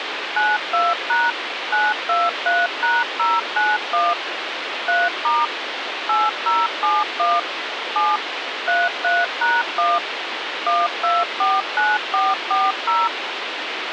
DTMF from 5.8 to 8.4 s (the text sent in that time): 8071 7